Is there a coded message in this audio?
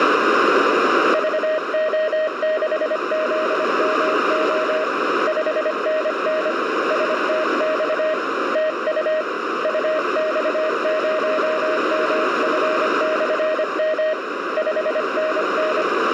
Yes: Morse code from 1.1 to 15.9 s, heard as a keyed tone, hand-sent with a paddle, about 25 wpm, 620 Hz, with heavy radio static and a narrow filter. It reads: VO6ZMO 5NN STX TU UX0MF/M 5NN